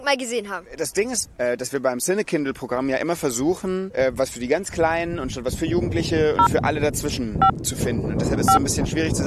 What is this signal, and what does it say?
DTMF, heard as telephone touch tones, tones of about 100 ms. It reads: 0 5 5